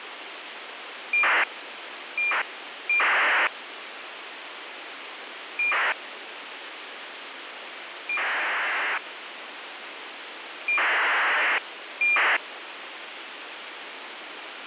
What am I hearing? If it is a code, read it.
ACARS aircraft data, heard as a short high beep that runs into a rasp, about 2400 baud, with radio hiss.